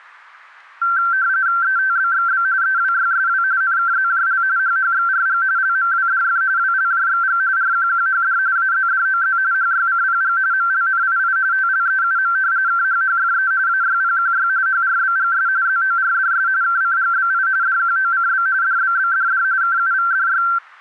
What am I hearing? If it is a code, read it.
RTTY (45.45 baud, 170 Hz shift), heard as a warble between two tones, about 1460 Hz centre, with static crashes. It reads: ETBXB EWYSW NKZJL HHXRG LMWDF WLJXG RQQHD AZDOZ HYCPG MLNII TLEUM KHHFE AYPQY HRBGS ZORDS KCGBI DQOCB DBBDD KUVDY